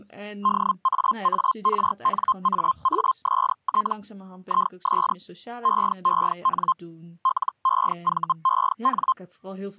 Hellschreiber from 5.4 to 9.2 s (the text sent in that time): EEN LEVEN